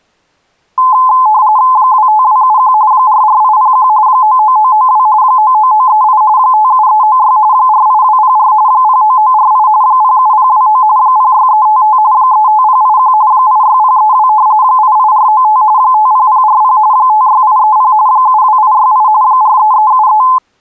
RTTY (45.45 baud, 170 Hz shift), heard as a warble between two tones, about 940 Hz centre. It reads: 25271 44801 99992 99938 57396 48204 09948 07029 06355 35081 86032 88495 50040 56830 72868 43373